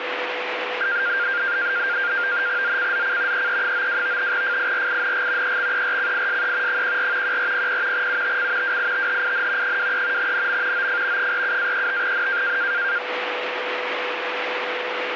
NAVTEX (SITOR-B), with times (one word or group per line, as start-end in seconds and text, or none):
2.6-3.5 ZCZC
3.3-4.3 EE92
4.3-5.6 FIRING
5.4-6.8 EXERCISE
6.7-7.4 14
7.2-8.1 1400
7.9-8.8 UTC
8.6-9.8 WITHIN
9.6-10.3 23
10.2-10.9 NM
10.7-11.3 OF
11.2-12.6 47-35N